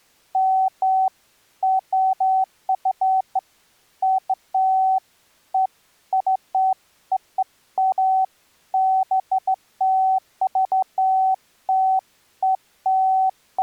Beeps of irregular length. There is no code.